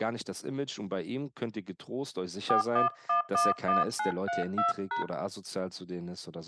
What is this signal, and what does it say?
DTMF, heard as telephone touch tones, dialled by hand, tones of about 150 ms, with speech in German. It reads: 41111932#